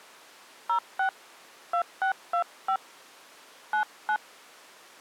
DTMF, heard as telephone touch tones, dialled by hand, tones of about 90 ms. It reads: 06 2625 99